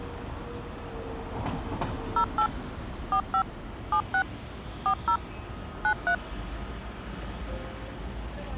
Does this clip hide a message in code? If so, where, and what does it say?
Yes: DTMF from 2.2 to 6.1 s, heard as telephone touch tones, dialled by machine, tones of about 80 ms, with hum and the noise of a residential street. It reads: 08 45 76 40 93